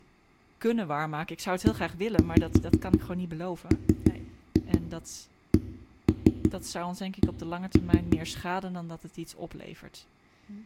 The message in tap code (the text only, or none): EMCC